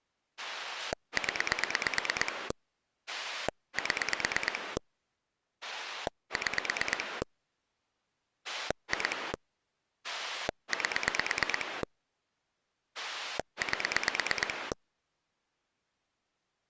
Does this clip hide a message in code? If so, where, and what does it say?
Yes: pulse dialling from 0.4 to 14.7 s, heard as a rotary dial, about 9 pulses a second. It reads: 0 7 6 2 8 8